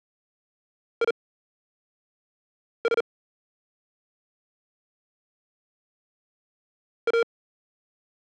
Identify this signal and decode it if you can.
Morse code, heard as electronic beeps, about 39 wpm, spaced as for 5 wpm, 460 Hz. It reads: IS A